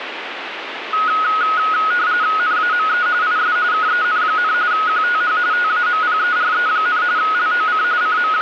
RTTY (45.45 baud, 170 Hz shift), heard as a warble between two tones, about 1360 Hz centre, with radio static. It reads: NAME IS KEN, QTH TAMPERE, LOC …